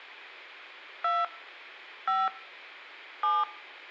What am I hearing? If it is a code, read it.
DTMF, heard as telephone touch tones, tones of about 200 ms. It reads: 2 5 7